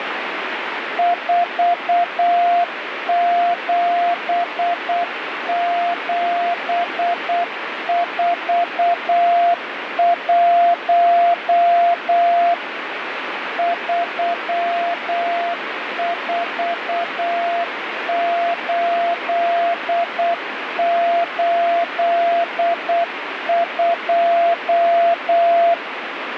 Morse code, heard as a keyed tone, machine-sent, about 8 wpm, 690 Hz, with radio static. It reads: 47741 34882